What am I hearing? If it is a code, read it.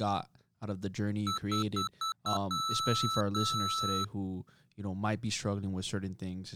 Beep code, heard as beeps from a small speaker, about 1320 Hz, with speech in English. 5 short, 2 long.